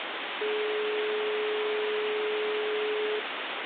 Telephone call progress tone (425 Hz plan, as in most of Europe), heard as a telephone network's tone, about 420 Hz, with phone line noise. Dial tone.